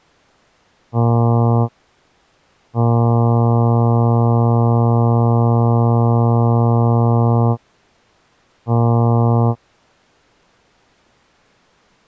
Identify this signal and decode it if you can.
Ship horn signal, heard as a ship's horn, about 120 Hz. 1 short, 1 long, 1 short. At sea: a vessel at anchor warns of its position.